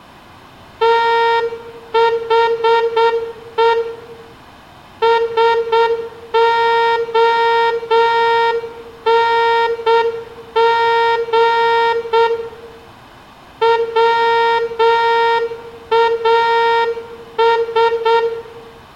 Morse code, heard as a horn, hand-sent with a straight key, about 7 wpm, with room echo. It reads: THE SONG WAS